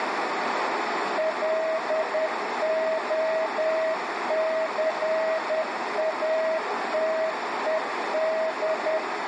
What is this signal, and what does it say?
Morse code, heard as a keyed tone, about 10 wpm, 640 Hz, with radio static, a narrow filter and room echo. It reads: LOCATED